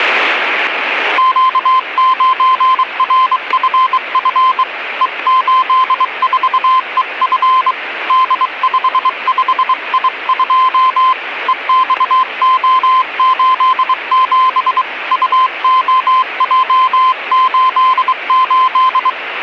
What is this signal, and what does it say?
Morse code, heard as a keyed tone, hand-sent with a bug key, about 23 wpm, 1040 Hz, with radio static. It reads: Q9RFF E84EF D55I2 EXO87 UOJ88